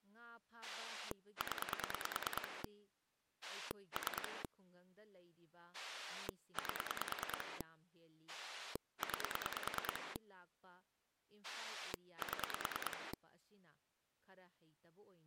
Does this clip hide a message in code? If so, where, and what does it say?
Yes: pulse dialling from 0.6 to 13.1 s, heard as a rotary dial, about 9 pulses a second, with speech in Manipuri. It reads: 0 3 8 9 7